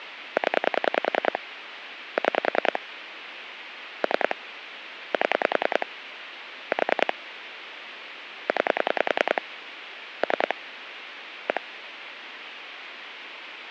Pulse dialling, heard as clicks on a phone line, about 10 pulses a second, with phone line noise. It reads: 0 6 3 7 4 9 3 1